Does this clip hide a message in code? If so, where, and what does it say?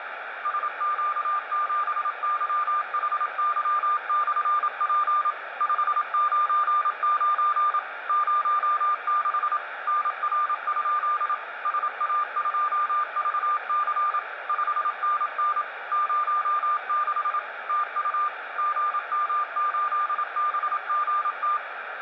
Yes: Morse code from 0.4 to 21.6 s, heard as a keyed tone, machine-sent, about 27 wpm, 1200 Hz, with radio static and room echo. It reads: SQ7YHY/P 599 06 NR? SA2VC 5NN 06 TU GM8BGT